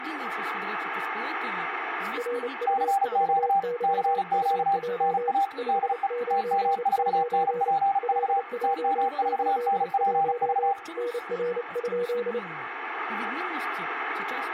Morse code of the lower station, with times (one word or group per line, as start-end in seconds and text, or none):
2.2-5.3 RU4YUJ
5.6-7.7 599
8.0-10.7 LJ81
11.0-12.4 NR?